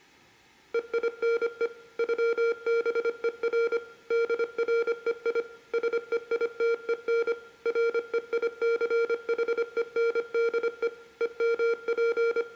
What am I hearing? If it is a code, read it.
Morse code (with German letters), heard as electronic beeps, machine-sent, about 25 wpm, 460 Hz, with room echo. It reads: EINE ÜBER DREI SEITEN REICHENDE …